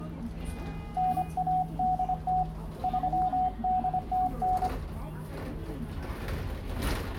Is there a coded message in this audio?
Yes: Morse code (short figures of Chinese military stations) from 0.9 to 4.7 s, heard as a keyed tone, hand-sent with a paddle, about 25 wpm, 740 Hz, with room echo and the noise inside a bus. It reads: 9180 3809